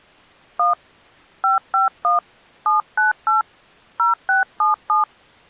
DTMF, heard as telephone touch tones, dialled by hand, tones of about 140 ms. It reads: 1 551 798 0677